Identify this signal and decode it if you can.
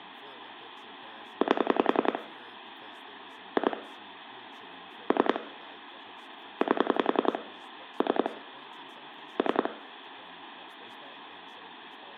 Pulse dialling, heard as clicks on a phone line, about 10 pulses a second, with phone line noise, room echo and speech in English. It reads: 8 2 3 8 3 3